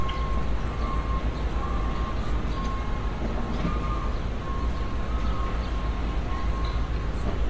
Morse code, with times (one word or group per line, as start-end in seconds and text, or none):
none